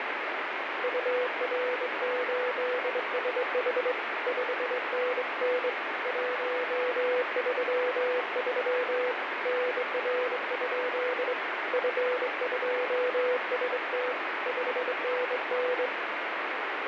Morse code, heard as a keyed tone, hand-sent with a straight key, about 23 wpm, 500 Hz, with heavy radio static. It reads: UR8SH 5NN 133 NR? F2ST 5NN